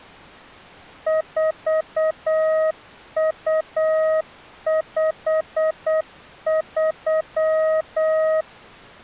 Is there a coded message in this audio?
Yes: Morse code (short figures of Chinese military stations) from 1.0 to 8.5 s, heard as a keyed tone, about 8 wpm, 630 Hz. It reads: 4253